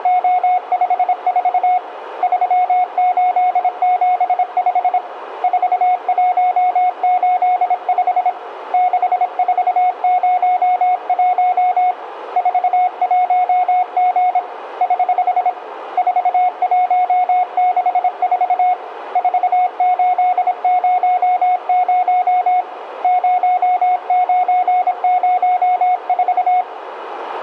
Morse code, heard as a keyed tone, hand-sent with a paddle, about 26 wpm, 730 Hz, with radio static and room echo. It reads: … 3875 4185 6401 41G <HH> 4164 4800 0904